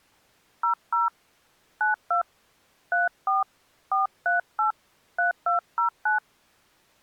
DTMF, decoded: 00 92 34 438 3209

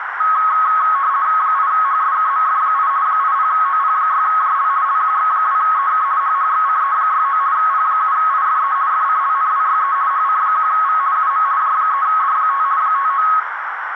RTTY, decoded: 8HSKMF8 80OP6JL LQX2EK HHXCE69 P7IFE FCLNWYE HC1V UM J3D5 59

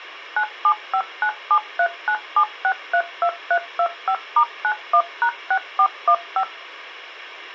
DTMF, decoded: 97597397632325*91#6415

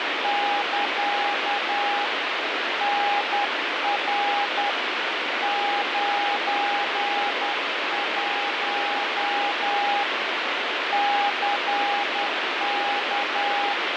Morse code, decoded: <KA> NR 91 CK

